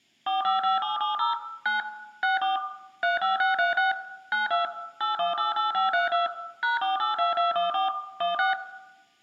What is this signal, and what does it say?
DTMF, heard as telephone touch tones, dialled by machine, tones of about 140 ms, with room echo. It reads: 455770 9 64 35636 92 8188532 #482214 16